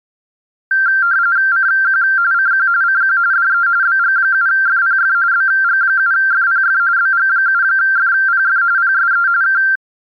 RTTY (45.45 baud, 170 Hz shift), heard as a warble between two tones, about 1470 Hz centre. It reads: CQ CQ CQ DE BG7FPF BG7FPF BG7FPF PSE K